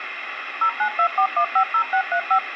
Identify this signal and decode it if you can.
DTMF, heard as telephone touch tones, dialled by machine, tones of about 80 ms, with phone line noise. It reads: 0924150635